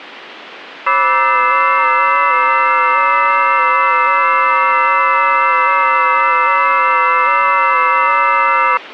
FT8 (several signals at once), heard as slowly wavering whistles, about 6.25 baud, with radio static.